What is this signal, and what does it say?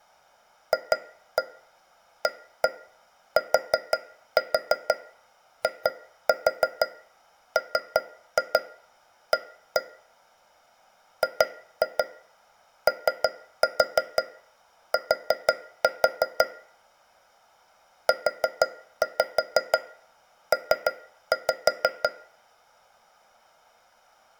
Tap code, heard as taps on a metal pipe, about 6 knocks a second, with room echo. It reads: FATIMA GOT UP